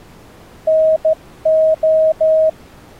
Morse code (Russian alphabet), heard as a keyed tone, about 14 wpm, 630 Hz. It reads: НО